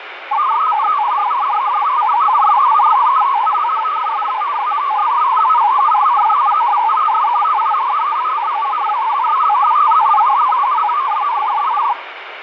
Multi-tone FSK (Olivia or MFSK type), about 500 Hz wide, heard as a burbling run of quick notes, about 62.5 baud, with radio static.